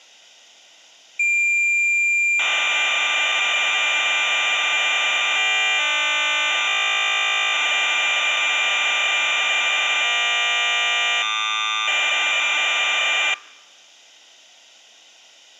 Cassette data (Kansas City type), 1200 baud, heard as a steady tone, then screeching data.